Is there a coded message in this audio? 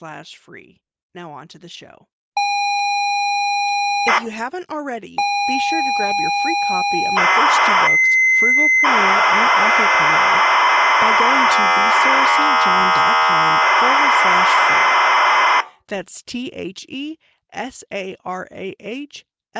Yes: ZX Spectrum tape loading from 2.4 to 15.6 s, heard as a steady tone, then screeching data, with speech in English.